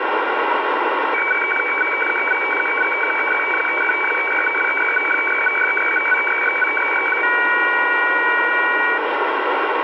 Weather fax (radiofax), 120 lines a minute, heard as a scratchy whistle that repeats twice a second, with radio static.